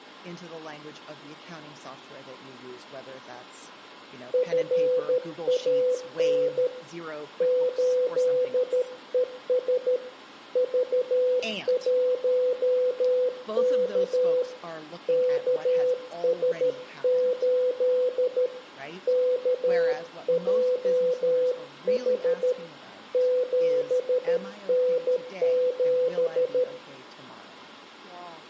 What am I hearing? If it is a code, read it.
Morse code, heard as a keyed tone, hand-sent with a paddle, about 13 wpm, 500 Hz, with room echo and speech in English. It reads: FAN 8ES V1K KS8 KJH 7N7